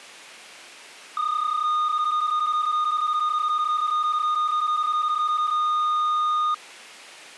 PSK31 (31.25 baud), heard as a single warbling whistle, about 1230 Hz.